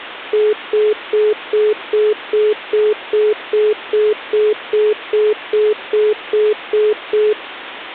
Telephone call progress tone (single-tone plan, as in most of Europe), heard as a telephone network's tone, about 420 Hz, 0.2 s on and 0.2 s off. Congestion tone.